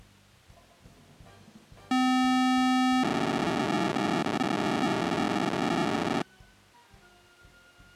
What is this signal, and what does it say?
POCSAG pager data (512 baud), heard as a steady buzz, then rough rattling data.